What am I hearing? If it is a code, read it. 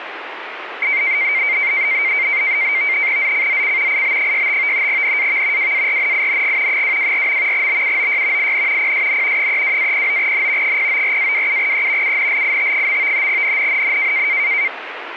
NAVTEX (SITOR-B), 100 baud, 170 Hz shift, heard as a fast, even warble, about 2200 Hz centre, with radio static. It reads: ZCZC IB65 NAV WARNING 224. BUOY IN PSN 32-09N 094-27E UNLIT. NNNN